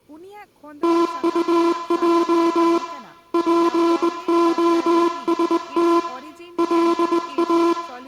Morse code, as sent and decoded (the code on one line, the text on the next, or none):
- ..- .--- / .--. --- ... - / .-.. .-
TUJ POST LA